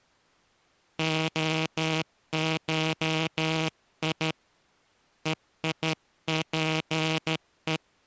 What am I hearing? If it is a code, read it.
Morse code (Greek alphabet), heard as a buzzer, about 12 wpm. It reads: ΟΧΙ ΕΙΠΕ